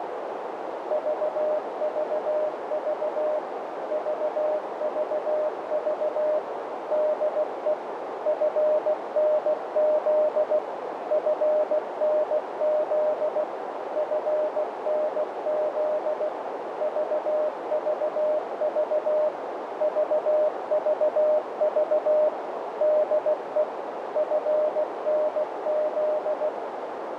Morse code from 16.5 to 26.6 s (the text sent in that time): VVV VVV DE FNZ